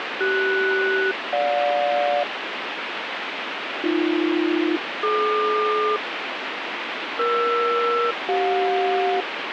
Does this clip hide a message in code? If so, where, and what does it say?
Yes: aircraft SELCAL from 0.2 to 9.2 s, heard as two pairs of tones, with radio static. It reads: CS-GJ AB-DQ ER-CJ